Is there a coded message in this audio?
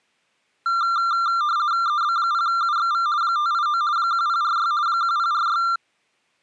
Yes: RTTY (50 baud, 170 Hz shift) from 0.7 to 5.8 s, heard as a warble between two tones, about 1280 Hz centre. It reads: EB0UXV 589 1046 1046